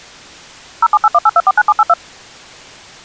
DTMF, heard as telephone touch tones, dialled by machine, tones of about 40 ms. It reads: 07818249782